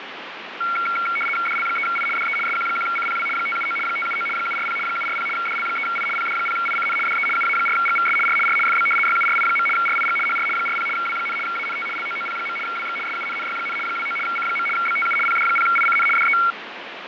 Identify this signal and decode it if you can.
RTTY (75 baud, 850 Hz shift), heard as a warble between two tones, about 1800 Hz centre, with radio static and fading. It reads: DL3I DE SQ1CPW 579 579 740 740 DL3I PD0ICN DE UA4GVS R R FB YURI. RIG HR 40 W, ANT LOOP. WX SUNNY, 29 C. BTU PD0ICN DE